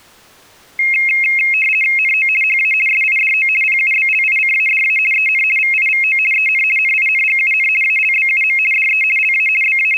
RTTY (50 baud, 450 Hz shift), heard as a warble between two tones, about 2350 Hz centre. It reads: NO HA SIDO PUBLICADA EN VIVO EN NINGUN ALBUM DE LA …